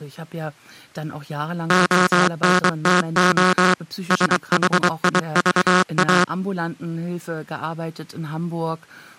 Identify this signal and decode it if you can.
Morse code, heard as a buzzer, machine-sent, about 23 wpm, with speech in German. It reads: ONTO SHIVA